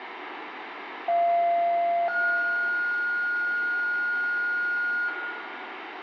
Two-tone page, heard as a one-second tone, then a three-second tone, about 690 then 1430 Hz, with radio hiss and room echo.